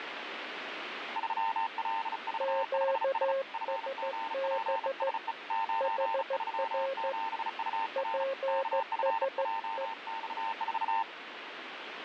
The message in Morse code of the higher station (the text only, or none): 3LV5S FGPSE 937UR KFJX4